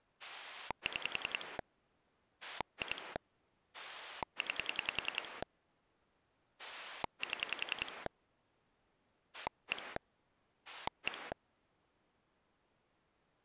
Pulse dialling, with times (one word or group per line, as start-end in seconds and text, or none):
0.2-1.6 6
2.4-3.2 2
3.7-5.4 9
6.6-8.1 7
9.3-10.0 1
10.7-11.3 1